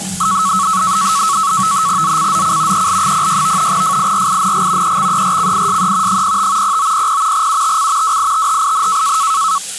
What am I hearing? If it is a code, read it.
NAVTEX (SITOR-B), 100 baud, 170 Hz shift, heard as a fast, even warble, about 1210 Hz centre, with the noise of a restroom. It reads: ZCZC EL06 FIRING EXERCISE 05 0900 UTC WITHIN